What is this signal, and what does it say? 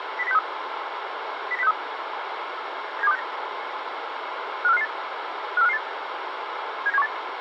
Five-tone selective call (EEA), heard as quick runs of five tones, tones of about 40 ms, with radio hiss. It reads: 09063 09063 97269 54558 54558 79718